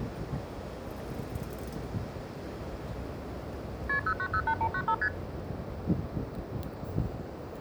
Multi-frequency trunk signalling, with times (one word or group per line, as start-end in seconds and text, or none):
3.9-4.0 KP
4.1-4.9 0908195
5.0-5.1 ST